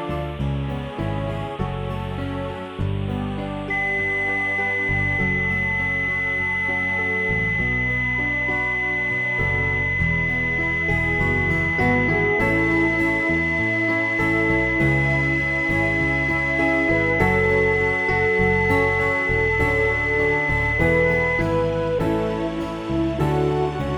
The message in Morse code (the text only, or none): none